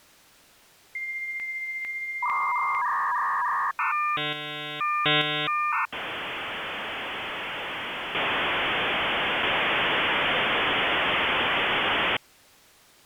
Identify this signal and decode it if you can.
Dial-up modem handshake (V.34 or later), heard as a whistle, warbles, then hiss.